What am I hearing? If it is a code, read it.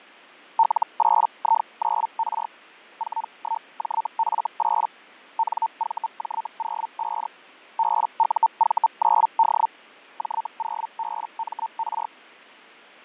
Hellschreiber (Feld-Hell, 122.5 baud), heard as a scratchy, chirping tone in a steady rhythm, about 900 Hz, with fading. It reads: L8I9R 41JF8 NVJ05 BUV9D J0BMR